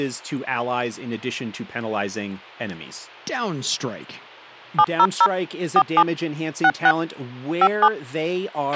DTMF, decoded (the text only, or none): 700 47 66 57